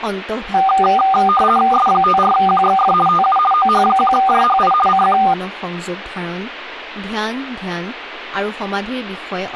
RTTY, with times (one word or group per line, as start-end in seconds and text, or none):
1.7-2.9 S54QXF
3.1-3.4 TU
3.5-4.7 OH1JHI
4.9-5.2 CQ